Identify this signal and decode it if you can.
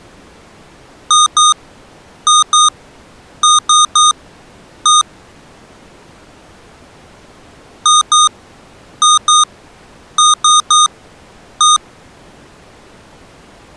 Beep code, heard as beeps from a small speaker, played twice, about 1230 Hz. 2-2-3-1. In Phoenix BIOS tables: unexpected interrupt.